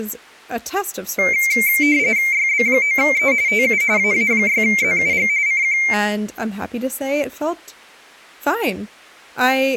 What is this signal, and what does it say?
RTTY (45.45 baud, 170 Hz shift), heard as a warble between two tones, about 2200 Hz centre, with speech in English. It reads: YB9E TU AA6ZUG CQ